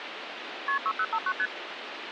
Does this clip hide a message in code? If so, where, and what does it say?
Yes: multi-frequency trunk signalling (R1, as on North American trunks) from 0.7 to 1.5 s, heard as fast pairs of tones, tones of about 60 ms, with phone line noise. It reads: KP 6059 ST